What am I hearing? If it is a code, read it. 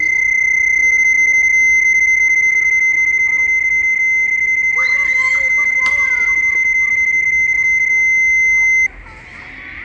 PSK31 (31.25 baud), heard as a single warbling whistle, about 2050 Hz, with radio static and the noise of a park.